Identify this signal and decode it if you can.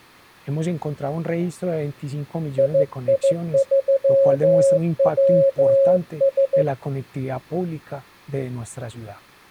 Morse code, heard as a keyed tone, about 15 wpm, 550 Hz. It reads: II3WS